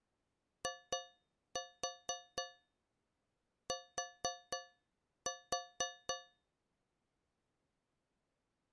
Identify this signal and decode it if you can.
Tap code, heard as taps on a metal pipe, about 4 knocks a second. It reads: IT